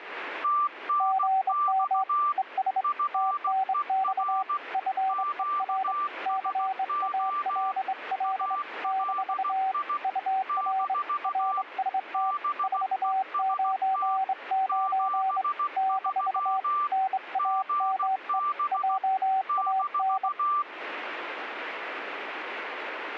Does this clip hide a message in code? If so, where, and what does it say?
Yes: Morse code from 0.4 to 20.7 s, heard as two keyed tones, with radio static. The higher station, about 16 wpm, 1180 Hz: TNX FER QSO ALI - BEST 73 GB -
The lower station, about 24 wpm, 760 Hz: GM ES TNX FER CALL - UR RST 499 - NAME JAN